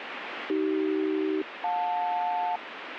Aircraft SELCAL, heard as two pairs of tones, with radio static. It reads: AC-JL